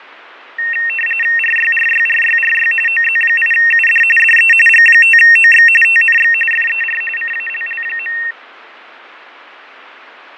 RTTY (45.45 baud, 850 Hz shift), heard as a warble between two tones, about 2300 Hz centre, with radio static and fading. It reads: RYRYRYRY OZ8UD DE G5OX TNX FER CALL.